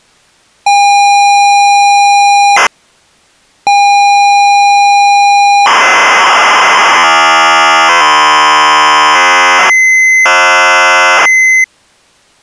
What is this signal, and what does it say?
ZX Spectrum tape loading, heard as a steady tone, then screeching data.